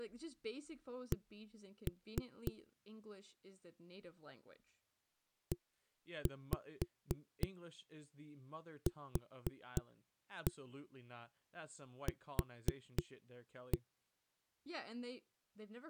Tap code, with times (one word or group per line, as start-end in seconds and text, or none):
1.1-2.5 C
5.5-13.8 EQQ